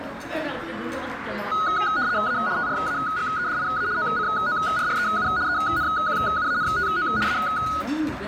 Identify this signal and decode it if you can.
RTTY (75 baud, 170 Hz shift), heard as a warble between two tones, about 1360 Hz centre, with radio static, a narrow filter and the noise of a restaurant. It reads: A TRAGEDIA OCORREU ENQUANTO A